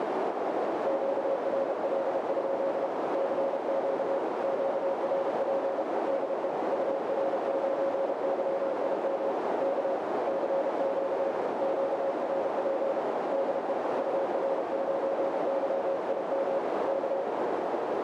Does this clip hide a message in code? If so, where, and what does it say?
Yes: Morse code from 0.8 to 17.3 s, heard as a keyed tone, hand-sent with a paddle, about 32 wpm, 550 Hz, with heavy radio static and a narrow filter. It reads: QRL? CQ QRP DE UR9YIM K CQ QRP DE UR9YIM K